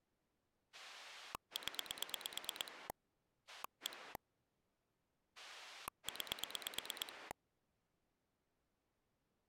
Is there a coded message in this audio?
Yes: pulse dialling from 0.7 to 7.3 s, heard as a rotary dial, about 9 pulses a second. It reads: 0 1 9